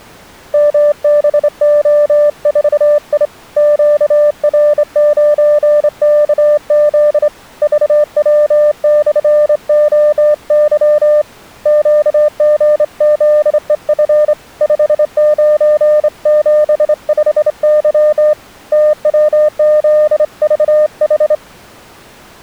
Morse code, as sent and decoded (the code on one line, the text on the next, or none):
-- -... --- ....- .. / --.- .-. ----. -.- --.. / ...- .-- -..-. --- -.-- / --.- --. --.. . ..-. / ..... ----. --... ..... -.-- / - .-- --.. ...- ....
MBO4I QR9KZ VW/OY QGZEF 5975Y TWZVH